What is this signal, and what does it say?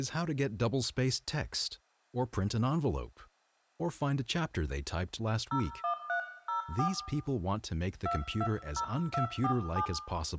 DTMF, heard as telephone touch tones, dialled by hand, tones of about 90 ms, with room echo and speech in English. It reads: 01304 220247